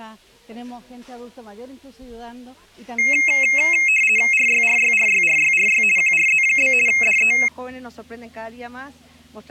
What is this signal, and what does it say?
RTTY (50 baud, 450 Hz shift), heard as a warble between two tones, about 2350 Hz centre. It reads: RYRYRYRYRY QRZ? DE